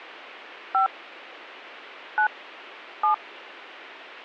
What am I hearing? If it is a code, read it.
DTMF, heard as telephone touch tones, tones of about 100 ms. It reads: 5 9 7